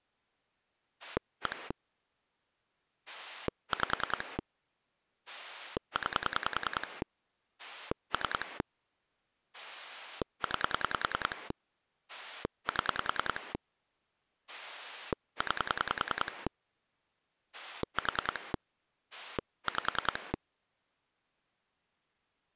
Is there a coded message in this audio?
Yes: pulse dialling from 1.0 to 20.4 s, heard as a rotary dial, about 10 pulses a second. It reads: 1 5 9 3 9 7 9 4 5